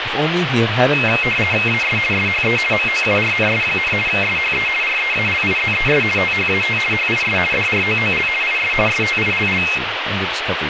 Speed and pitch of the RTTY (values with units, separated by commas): 50 baud, 450 Hz shift, 2350 Hz centre